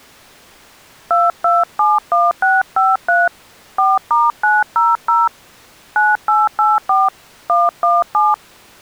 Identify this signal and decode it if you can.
DTMF, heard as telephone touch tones, dialled by hand, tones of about 190 ms. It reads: 2271653 4*900 9884 117